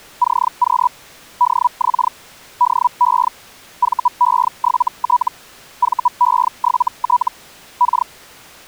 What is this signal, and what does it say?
Hellschreiber (Feld-Hell, 122.5 baud), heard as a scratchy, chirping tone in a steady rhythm, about 980 Hz. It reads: CQ DX DE VE7T VE7T K